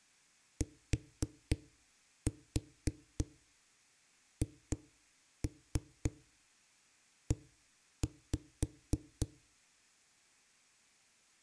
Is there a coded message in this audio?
Yes: tap code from 0.6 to 9.3 s, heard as knocks on a wall, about 3 knocks a second. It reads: THE